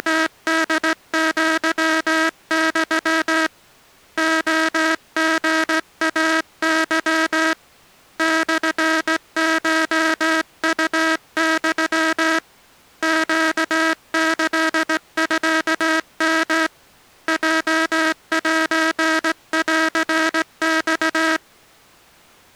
Morse code (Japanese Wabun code), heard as a buzzer, hand-sent with a straight key, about 17 wpm. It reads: … レリイケ モコウユ ネキミヨ ヲセンマ